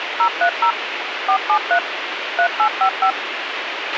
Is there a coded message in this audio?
Yes: DTMF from 0.2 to 3.1 s, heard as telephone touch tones, dialled by machine, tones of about 80 ms, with radio hiss and a squelch burst at the end. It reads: 030 473 3855